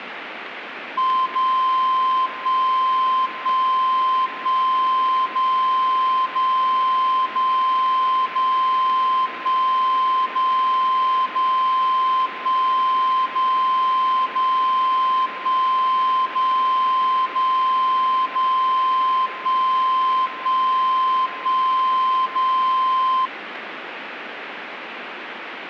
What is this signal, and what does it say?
Radio time signal (DCF77), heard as a tone whose level steps once a second, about 1040 Hz, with radio static. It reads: 0 1 1 1 0 0 0 0 1 0 0 1 0 0 1 0 0 0 1 1 1 0